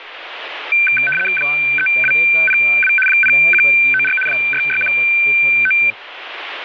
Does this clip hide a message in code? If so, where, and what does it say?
Yes: RTTY (75 baud, 850 Hz shift) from 0.7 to 5.9 s, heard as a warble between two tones, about 1950 Hz centre, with radio static and speech in Punjabi. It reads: 3202 0194 6619